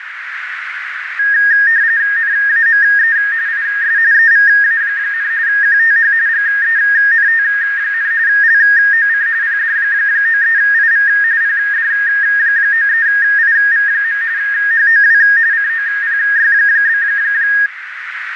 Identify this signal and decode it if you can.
RTTY (45.45 baud, 170 Hz shift), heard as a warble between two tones, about 1750 Hz centre, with radio static and a narrow filter. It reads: NAME IS EVA, QTH GENT, LOC PD93IV PD93IV. HOW COPY?